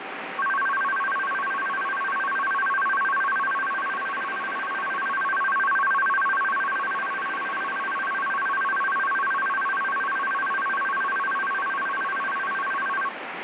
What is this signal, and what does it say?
A tone that alternates evenly between two pitches, with radio static. There is no code.